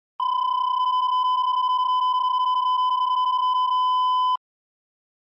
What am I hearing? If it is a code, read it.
PSK31 (31.25 baud), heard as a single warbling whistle, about 1010 Hz.